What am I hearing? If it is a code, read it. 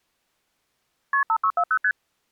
Multi-frequency trunk signalling (R1, as on North American trunks), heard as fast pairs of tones, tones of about 70 ms. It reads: KP 5640 ST